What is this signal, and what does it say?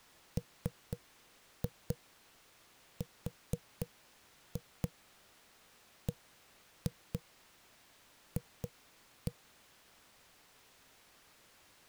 Tap code, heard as knocks on a wall, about 4 knocks a second. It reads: MRBF